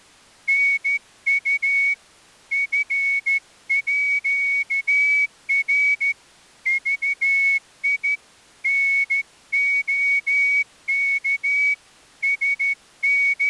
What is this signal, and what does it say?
Morse code (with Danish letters), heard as a whistle, hand-sent with a straight key, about 13 wpm. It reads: NU FÅR VI NOK …